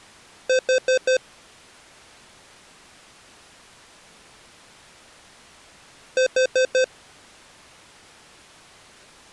Alarm pattern, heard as an alarm's beeps, played twice, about 520 Hz. Temporal four. Carbon monoxide.